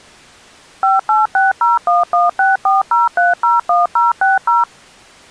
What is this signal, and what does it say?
DTMF, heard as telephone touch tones, dialled by machine, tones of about 160 ms. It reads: 586011640301060